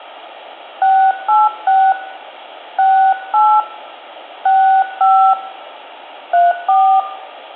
DTMF, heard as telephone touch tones, dialled by hand, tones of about 290 ms, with phone line noise and room echo. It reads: 686 68 65 34